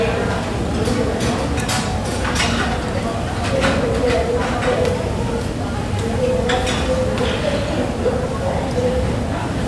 The noise of a cafe. There is no code.